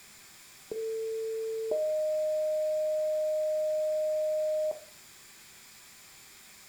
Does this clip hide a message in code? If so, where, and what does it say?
Yes: two-tone page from 0.7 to 4.7 s, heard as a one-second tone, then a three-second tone, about 450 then 620 Hz, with room echo.